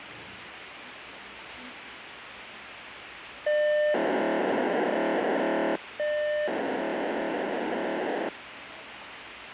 POCSAG pager data (1200 baud), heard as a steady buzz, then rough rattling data, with radio hiss and the noise of a cafe.